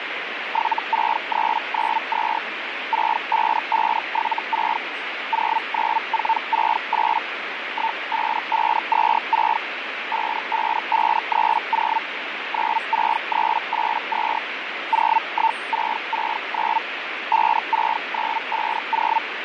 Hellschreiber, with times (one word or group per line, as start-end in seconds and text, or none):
0.5-2.4 76392
2.9-4.8 65576
5.3-7.2 09468
7.7-9.6 15526
10.1-12.0 55530
12.5-14.4 96382
14.9-16.8 01669
17.3-19.2 56950